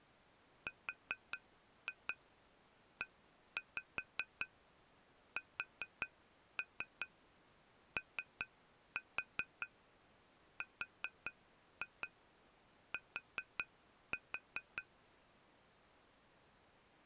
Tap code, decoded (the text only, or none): RESORT